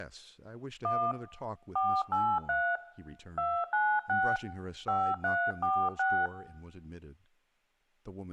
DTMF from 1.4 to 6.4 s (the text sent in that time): 483 296 5346